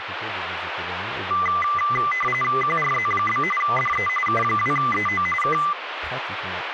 RTTY (45.45 baud, 850 Hz shift), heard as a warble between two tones, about 1600 Hz centre, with radio static and speech in French. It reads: QRZ? DE K2EO K